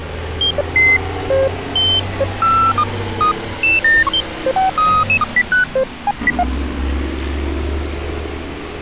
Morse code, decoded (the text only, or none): none